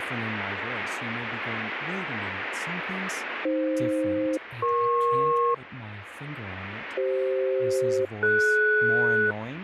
Aircraft SELCAL, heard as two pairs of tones, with radio static and speech in English. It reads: AF-EP CF-DS